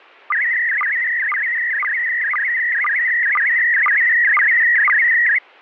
SSTV (slow-scan television), PD 120, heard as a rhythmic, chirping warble.